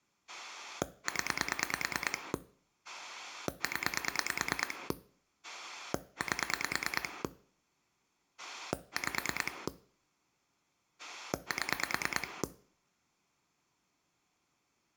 Pulse dialling, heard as a rotary dial, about 9 pulses a second, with room echo. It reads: 0 0 8 5 7